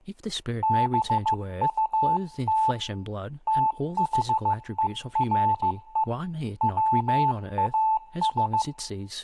Morse code, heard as a keyed tone, hand-sent with a paddle, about 15 wpm, 880 Hz, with room echo and speech in English. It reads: BUT THERE WAS